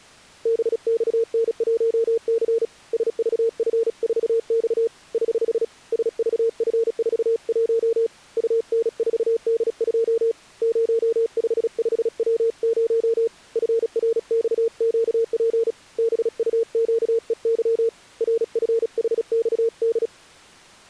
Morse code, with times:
0.5-2.6 BXN1C
2.9-4.9 SVF4X
5.1-5.6 <HH>
5.9-8.1 SVF41
8.4-10.3 UN4D2
10.6-13.3 055W0
13.6-15.7 FRXQP
16.0-17.9 BUQEY
18.2-20.1 RFHXD

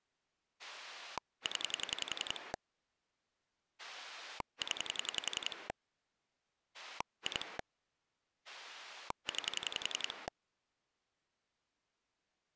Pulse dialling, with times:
0.6-2.5 0
3.8-5.7 0
6.7-7.6 2
8.5-10.3 9

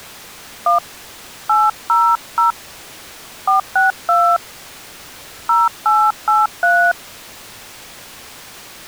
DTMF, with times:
0.7-0.8 1
1.5-2.5 800
3.5-4.4 462
5.5-6.9 0883

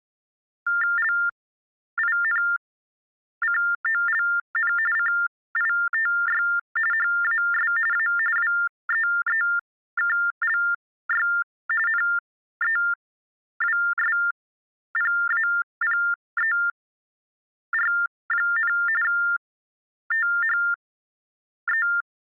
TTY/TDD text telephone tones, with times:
1.0-4.7 LINCOLN
5.0-6.4 CITY
6.9-7.7 HAS
7.9-8.1 A
8.4-11.3 WEEKLY
11.9-18.7 NEWSPAPER,
19.0-21.9 THE

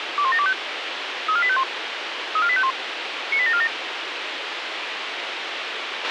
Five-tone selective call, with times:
0.2-0.5 21725
1.3-1.6 34851
2.4-2.7 34851
3.3-3.7 98747

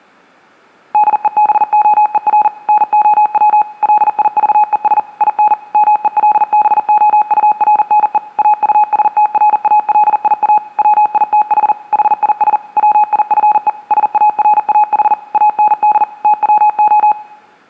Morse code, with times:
0.9-2.5 DEBOER
2.7-3.6 NOW
3.8-5.0 LIVES
5.2-5.5 IN
5.7-8.2 MELBOURNE
8.4-10.6 AUSTRALIA
10.8-11.7 WITH
11.9-12.6 HIS
12.8-13.7 WIFE
13.9-15.1 SARAH
15.3-16.0 AND
16.2-17.1 TWO

